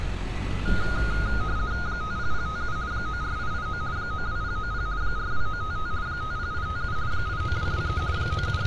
RTTY (50 baud, 170 Hz shift), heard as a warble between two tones, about 1340 Hz centre, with street noise. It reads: 50057 94889 92090 42955 50857 89223 …